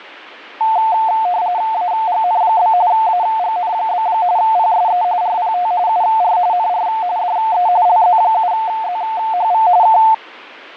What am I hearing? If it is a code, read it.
RTTY (45.45 baud, 170 Hz shift), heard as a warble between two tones, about 800 Hz centre, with fading. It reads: AGN? AGN? PSE RPT UR NR DE LZ7ZHV K